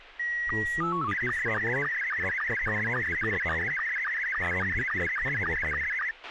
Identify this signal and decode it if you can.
SSTV (slow-scan television), Scottie S2, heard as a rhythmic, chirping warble, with radio hiss, a squelch burst at the end and speech in Assamese.